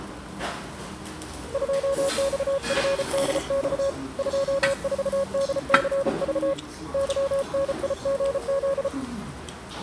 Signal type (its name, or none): Morse code